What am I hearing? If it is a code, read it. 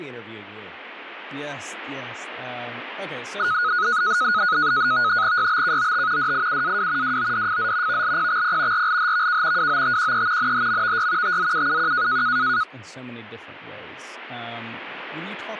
NAVTEX (SITOR-B), 100 baud, 170 Hz shift, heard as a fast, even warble, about 1360 Hz centre, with radio static and speech in English. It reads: YBKOT DIUAW WODFZ VLPXP RLHVK WOTQE NHMVY TZUUQ